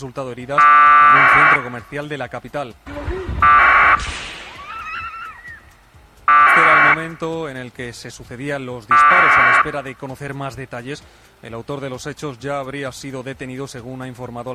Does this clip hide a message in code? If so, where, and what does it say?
Yes: packet radio (AX.25, as in APRS), 1200 baud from 0.6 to 9.6 s, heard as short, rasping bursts.